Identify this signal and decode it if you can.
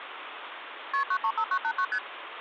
Multi-frequency trunk signalling (R1, as on North American trunks), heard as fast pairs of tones, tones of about 70 ms, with phone line noise. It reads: KP 935989 ST